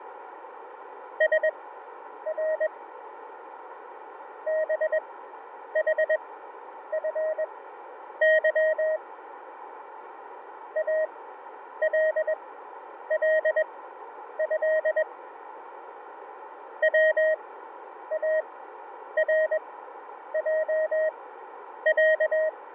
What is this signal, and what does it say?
Morse code (Arabic alphabet), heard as a keyed tone, machine-sent, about 21 wpm, spaced as for 9 wpm, 630 Hz, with radio static and fading. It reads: سر بحفظ الله وارجع